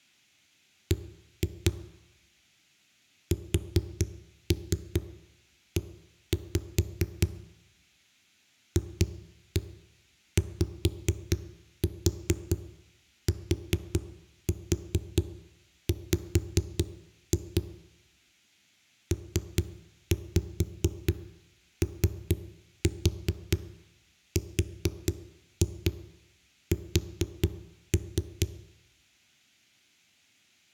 Tap code, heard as knocks on a wall, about 4 knocks a second, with room echo. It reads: B SE FYTW PORS